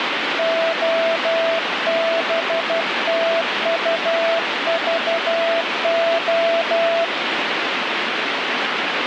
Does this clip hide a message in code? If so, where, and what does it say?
Yes: Morse code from 0.3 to 7.1 s, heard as a keyed tone, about 12 wpm, 660 Hz, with radio static. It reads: OBTUVO